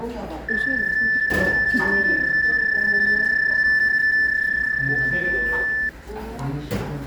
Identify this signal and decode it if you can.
PSK31 (31.25 baud), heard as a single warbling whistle, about 1750 Hz, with the noise of a restaurant.